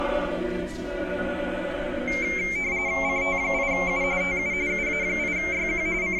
RTTY (45.45 baud, 170 Hz shift), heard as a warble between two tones, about 2200 Hz centre. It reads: CT8U TU UA8YQ …